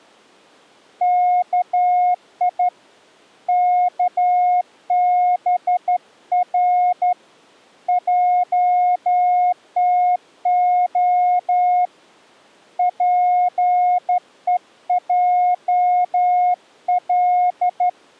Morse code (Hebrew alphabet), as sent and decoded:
-.- .. / -.- -... .-. / .--- - --- / .--. . .--- .-..
כי כבר עתה פועל

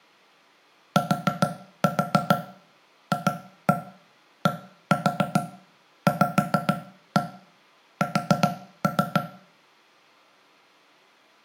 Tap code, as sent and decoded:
4-4 2-1 1-4 5-1 4-3
TFDVS

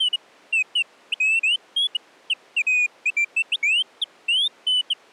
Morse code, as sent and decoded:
none

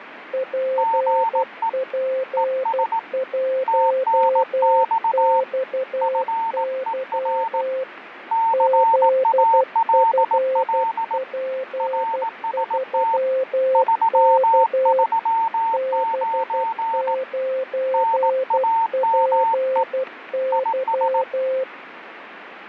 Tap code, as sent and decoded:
none

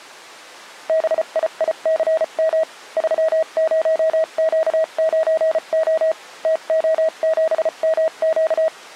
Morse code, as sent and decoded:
-... .. .. -.-. -- / ...-- ----- --.- ----. --- / - --- --... -- --.-
BIICM 30Q9O TO7MQ

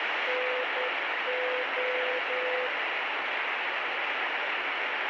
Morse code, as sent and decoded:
-. ---
NO

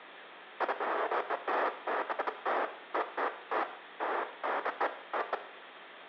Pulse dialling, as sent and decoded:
none

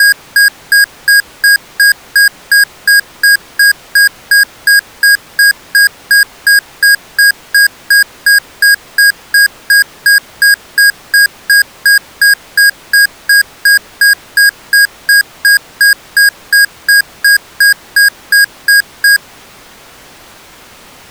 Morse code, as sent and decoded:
none

